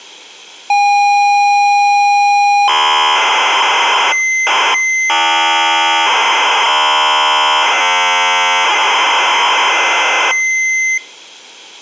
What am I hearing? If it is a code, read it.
ZX Spectrum tape loading, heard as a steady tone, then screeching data.